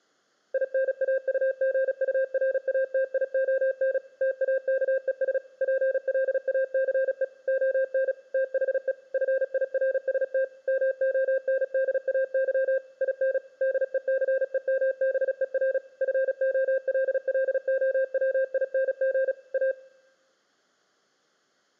Morse code, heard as a keyed tone, machine-sent, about 36 wpm, 530 Hz, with room echo. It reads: INAUGURATION TAKES PLACE ON THE FIRST MONDAY IN DECEMBER FOLLOWING A